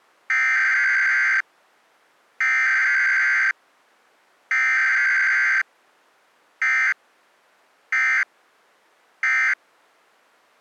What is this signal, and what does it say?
Emergency Alert System (SAME) tones (header bursts, then end-of-message bursts), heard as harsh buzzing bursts, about 520.83 baud.